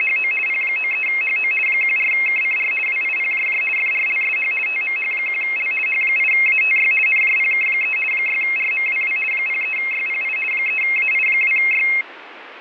RTTY (50 baud, 450 Hz shift), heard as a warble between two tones, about 2350 Hz centre, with radio static. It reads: … P93HO 14KCR WIPJJ FRLSH TMH1L H8ATY NJPK3 6RMWW 03YPI 3AI2Y